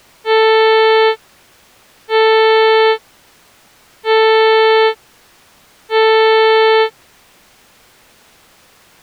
Ship horn signal, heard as a ship's horn, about 440 Hz. 4 short. At sea: a pilot vessel's identity signal in fog.